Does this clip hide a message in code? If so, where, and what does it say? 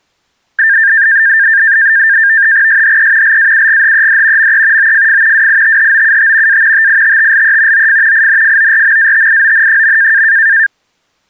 Yes: NAVTEX (SITOR-B), 100 baud, 170 Hz shift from 0.6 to 10.7 s, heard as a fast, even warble, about 1700 Hz centre. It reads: SHE LAUGHED ME OFF WITHOUT A TITTLE OF INFORMATION.